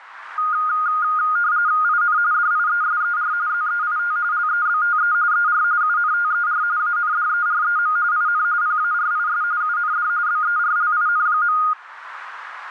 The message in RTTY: IN DIESER ZEIT LEBTE ER UNTER ANDEREM IN PARIS UND BERLIN.

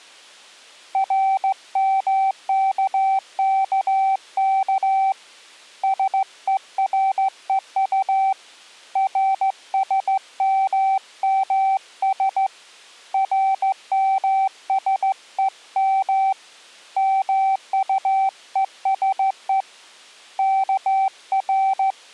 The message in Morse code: RMKKK SEREU RSMMS RMSEM MUESE …

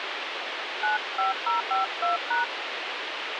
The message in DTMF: 95052#

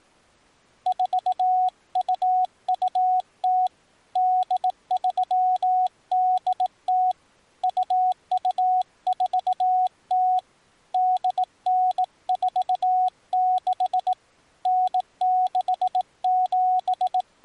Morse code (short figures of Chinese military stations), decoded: 4220 8380 2240 8946 …

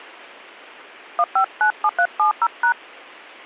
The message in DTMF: 1597370#

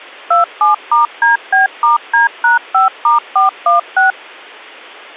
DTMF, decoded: 27*DB*D#5*416

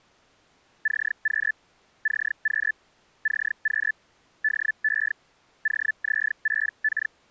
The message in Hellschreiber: CQ CQ CQ DE …

